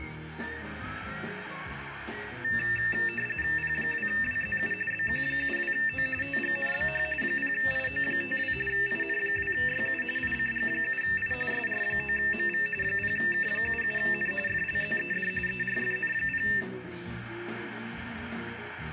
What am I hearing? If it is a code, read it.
RTTY (45.45 baud, 850 Hz shift), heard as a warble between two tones, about 2200 Hz centre, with radio static and room echo. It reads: P2WZU BQ72O TGNBH 0IO52 IN2YU ICG7I SR9MV 0K77N FLZED ERFN0